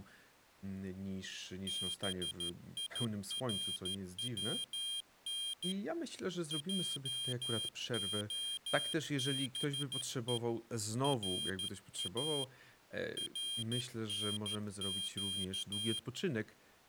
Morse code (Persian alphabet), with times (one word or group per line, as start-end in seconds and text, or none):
1.7-5.7 بیرون
6.5-10.4 جعبه
11.0-12.4 را
13.2-16.0 رنگ